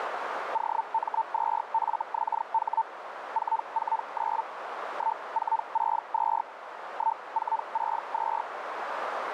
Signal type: Hellschreiber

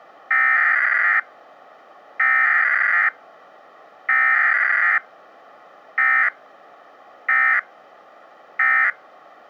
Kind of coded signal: Emergency Alert System (SAME) tones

